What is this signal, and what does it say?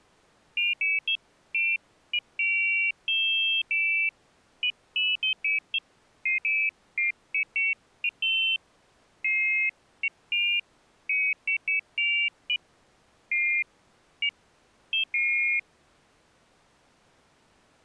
Pairs of high tones at irregular times. There is no code.